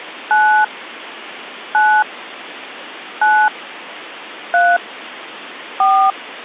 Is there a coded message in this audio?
Yes: DTMF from 0.3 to 6.1 s, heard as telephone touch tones, dialled by hand, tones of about 270 ms. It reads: 9 9 9 3 4